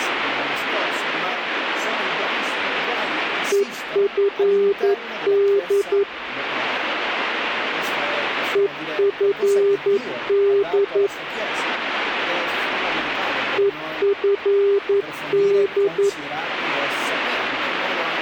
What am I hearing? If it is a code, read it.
Morse code, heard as a keyed tone, machine-sent, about 11 wpm, 400 Hz. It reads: EFD EFD EFD